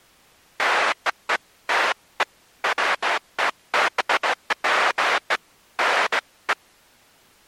Bursts of noise. There is no code.